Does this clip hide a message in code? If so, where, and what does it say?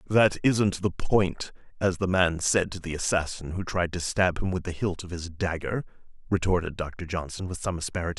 No, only speech in English.